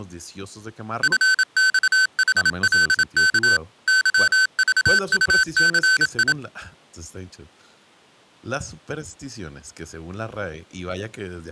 Morse code, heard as electronic beeps, machine-sent, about 27 wpm, 1550 Hz, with speech in Spanish. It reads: FXHLK YVUCI